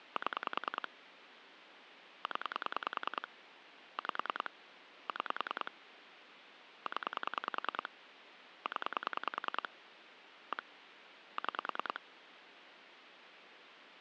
Pulse dialling, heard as clicks on a phone line, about 10 pulses a second, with phone line noise. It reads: 7 0 5 6 0 0 1 6